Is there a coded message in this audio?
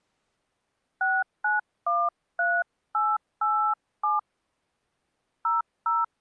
Yes: DTMF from 1.0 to 6.0 s, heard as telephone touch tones, dialled by hand, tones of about 240 ms. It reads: 6913887 00